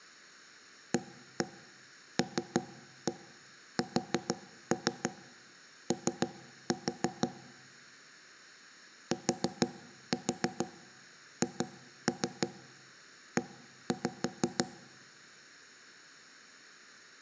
Tap code, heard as knocks on wood, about 6 knocks a second. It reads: ALSO THE